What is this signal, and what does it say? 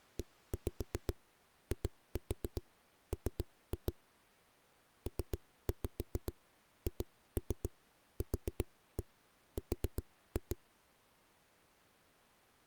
Tap code, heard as knocks on a wall, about 7 knocks a second. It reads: EIM PHQR